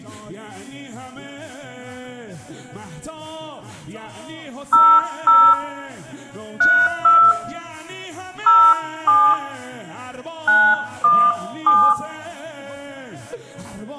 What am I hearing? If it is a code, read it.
DTMF, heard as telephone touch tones, dialled by hand, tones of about 270 ms, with room echo. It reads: 00 32 07 917